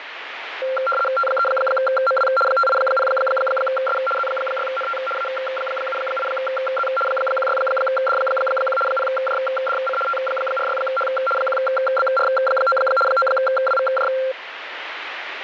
RTTY (75 baud, 850 Hz shift), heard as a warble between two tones, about 950 Hz centre, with radio static. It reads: T3MW 580S Z6NT A78Z 16D1 0JDC T46H 1BR9 9WVJ